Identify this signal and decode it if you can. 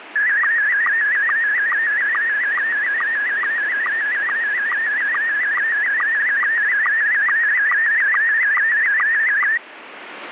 SSTV (slow-scan television), Scottie S1, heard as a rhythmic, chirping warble, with radio static.